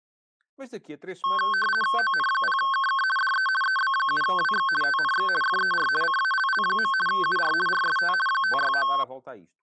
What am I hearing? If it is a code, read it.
RTTY (50 baud, 450 Hz shift), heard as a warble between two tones, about 1310 Hz centre, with speech in Portuguese. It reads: ON0KK DE EB7WX TNX FER CALL. UR RST 569